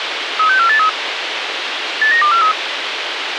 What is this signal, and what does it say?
Five-tone selective call (CCIR), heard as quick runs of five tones, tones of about 100 ms, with radio hiss. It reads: 36483 89243